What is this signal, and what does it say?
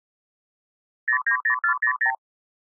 Multi-frequency trunk signalling (R2, with the far end's replies), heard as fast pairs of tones, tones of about 90 ms. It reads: 090400